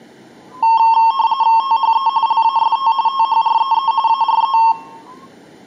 RTTY (45.45 baud, 170 Hz shift), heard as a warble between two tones, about 990 Hz centre. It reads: THE LAST THREE ARE